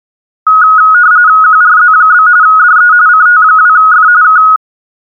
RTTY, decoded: QRZ? DE CT2F K

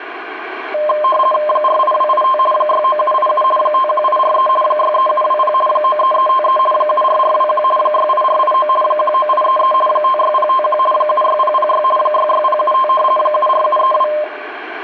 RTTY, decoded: 48285 69787 51843 63720 93353 74421 68489 19833 56051 76006 66075 74732

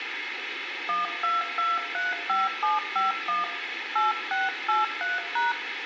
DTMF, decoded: 12235751 8683#

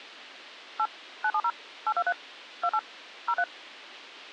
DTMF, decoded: 8 970 823 28 03

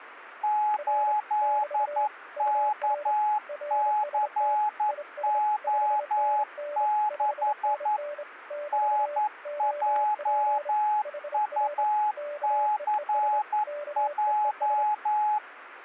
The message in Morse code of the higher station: 8KCO6 NJUCJ

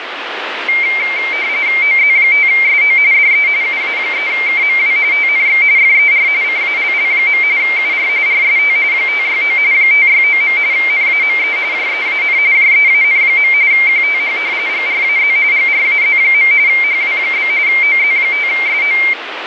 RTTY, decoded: OZ5SO DE UA3KMW TNX FER CALL. UR RST 569 569. NAME JEAN JEAN. QTH GRAZ GRAZ. HW? OZ5SO

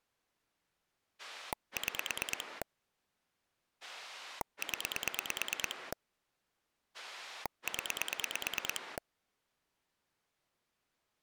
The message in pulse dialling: 6 0 0

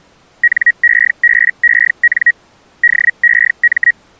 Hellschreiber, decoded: NEBEN DEM

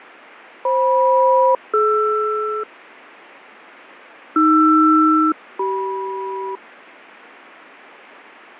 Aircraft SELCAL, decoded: FM-DR AR-CM

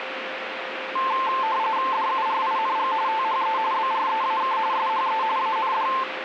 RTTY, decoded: DURING THE BREAK SHE AND

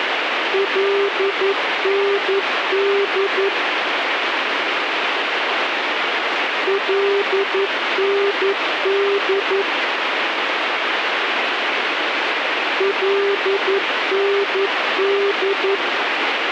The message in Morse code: LND LND LND

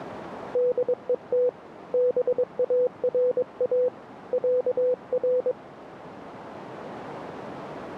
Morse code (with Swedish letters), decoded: DET BARA ÄR

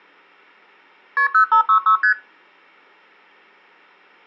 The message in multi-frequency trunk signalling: KP 0566 ST

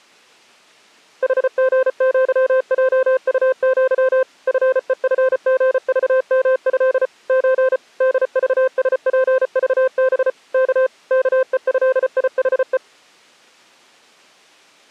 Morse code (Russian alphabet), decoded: ХГЪЙУЪ ФЕФГЖМЭ Ч ДЖСПЖБ К КЕЭИХЕ

